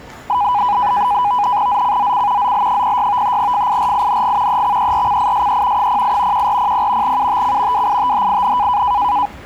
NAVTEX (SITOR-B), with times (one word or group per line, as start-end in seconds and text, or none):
1.7-2.5 ZCZC
2.4-3.4 ZL06
3.4-4.6 FIRING
4.5-5.9 EXERCISE
5.8-6.5 08
6.3-7.2 1400
7.0-7.9 UTC
7.7-8.8 WITHIN